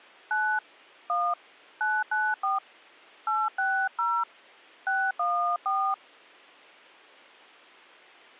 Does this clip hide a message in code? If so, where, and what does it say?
Yes: DTMF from 0.3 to 5.9 s, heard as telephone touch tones, dialled by hand, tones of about 270 ms. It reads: 9 1 994 860 614